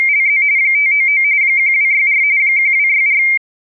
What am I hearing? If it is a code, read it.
RTTY (45.45 baud, 170 Hz shift), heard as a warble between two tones, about 2200 Hz centre. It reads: … 599 1264 1264